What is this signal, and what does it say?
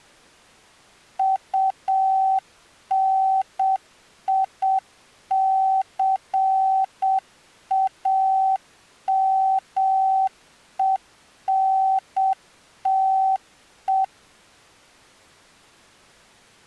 Morse code, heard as a keyed tone, machine-sent, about 7 wpm, 770 Hz. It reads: UNICAMENTE